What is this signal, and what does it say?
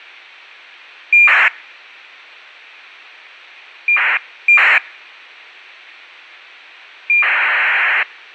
ACARS aircraft data, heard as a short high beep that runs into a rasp, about 2400 baud.